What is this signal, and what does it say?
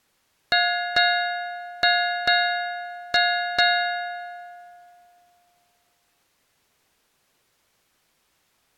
Ship's bell, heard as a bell. 6. Six half-hours of the watch have passed.